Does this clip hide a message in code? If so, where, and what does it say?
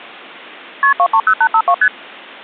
Yes: multi-frequency trunk signalling (R1, as on North American trunks) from 0.8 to 1.9 s, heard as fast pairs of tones, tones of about 70 ms. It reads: KP 230852 ST